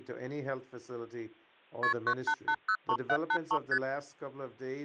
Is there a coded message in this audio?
Yes: multi-frequency trunk signalling (R1, as on North American trunks) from 1.8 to 3.8 s, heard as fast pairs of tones, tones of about 70 ms. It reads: KP 98803783 ST